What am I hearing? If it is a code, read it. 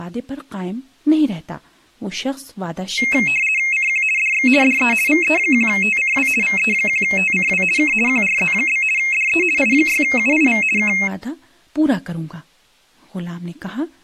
RTTY (50 baud, 450 Hz shift), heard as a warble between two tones, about 2350 Hz centre, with speech in Urdu. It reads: CQ DX DE VE1TCW VE1TCW K QRZ? DE I6UIV K